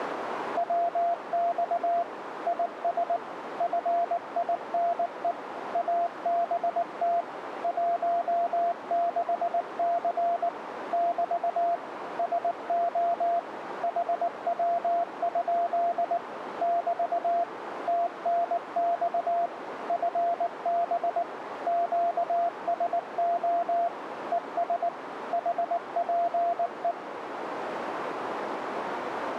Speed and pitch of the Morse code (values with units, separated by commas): 19 wpm, 690 Hz